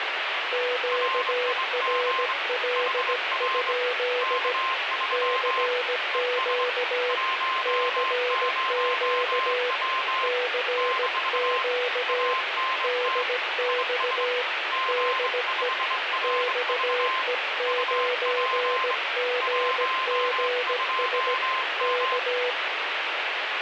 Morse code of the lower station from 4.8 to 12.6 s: CQ CQ CQ

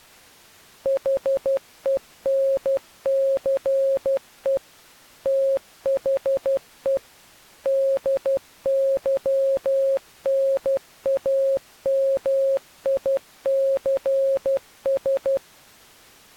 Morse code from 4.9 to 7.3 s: THE

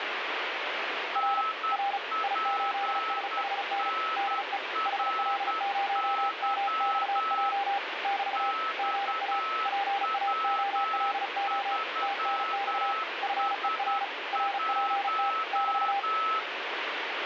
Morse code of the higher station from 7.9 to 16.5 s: XW3S1

